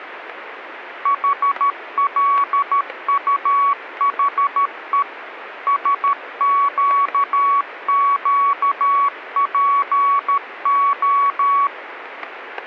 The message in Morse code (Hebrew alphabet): חלטחו שקקפה

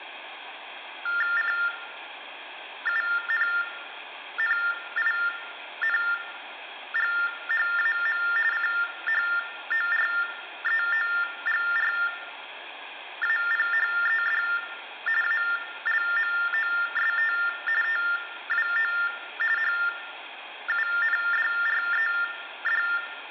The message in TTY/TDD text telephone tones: CUNNINGHAM CHOREOGRAPHED ALMOST TWO HUNDRED

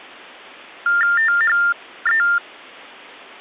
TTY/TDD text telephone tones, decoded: THE

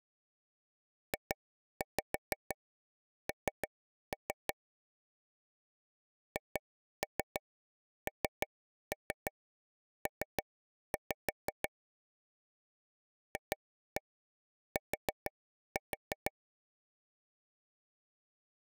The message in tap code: JN HNP FT

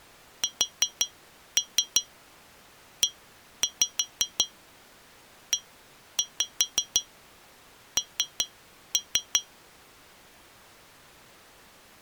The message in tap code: SEEN

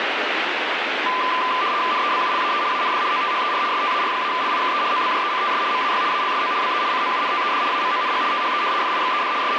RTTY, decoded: NEBULAE AND OTHER STAR-LIKE OBJECTS MAY ALSO BE COUNTED AMONG THE FIXED …

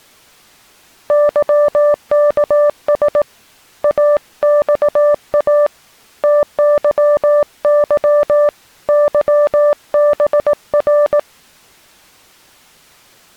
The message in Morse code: YKS AXA TYY YBR

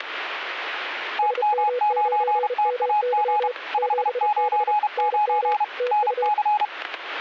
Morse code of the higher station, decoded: TM9TAG 599 NC

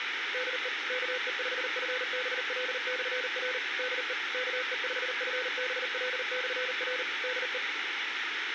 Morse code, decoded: DE KE5FBL/R DE KE5FBL/R DE

